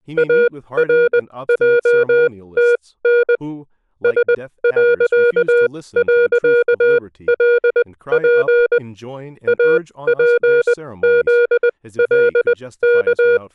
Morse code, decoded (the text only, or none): ARJTN S..LP APZLK